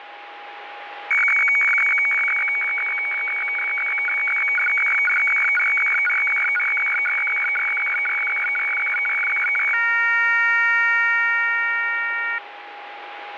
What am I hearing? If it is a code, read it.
Weather fax (radiofax), 120 lines a minute, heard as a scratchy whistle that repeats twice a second, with radio static and a steady whistle near 820 Hz.